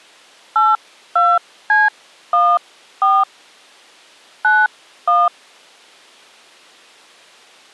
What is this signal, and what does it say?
DTMF, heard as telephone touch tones, dialled by hand, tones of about 250 ms. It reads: 82C14 91